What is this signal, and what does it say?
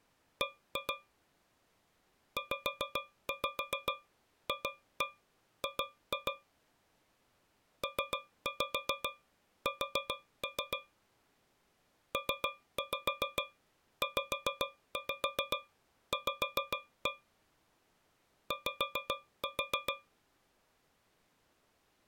Tap code, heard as taps on a metal pipe, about 7 knocks a second. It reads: B ZFG PS PZV Y